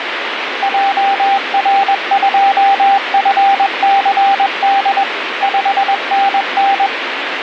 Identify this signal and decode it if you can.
Morse code, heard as a keyed tone, machine-sent, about 21 wpm, 790 Hz, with radio static. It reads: JR2FCD 5NN